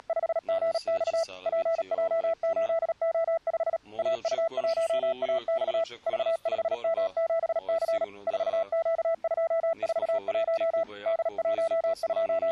Morse code, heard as a keyed tone, machine-sent, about 37 wpm, 660 Hz. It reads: … PJ8O5 AU1AX V5M7C 4Q241 …